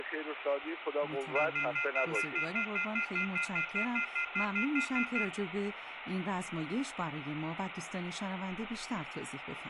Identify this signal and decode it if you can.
Telephone call progress tone (North American plan), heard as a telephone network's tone, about 1400, 2050, 2450, 2600 Hz, 0.1 s on and 0.1 s off, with phone line noise and room echo. Off-hook warning tone.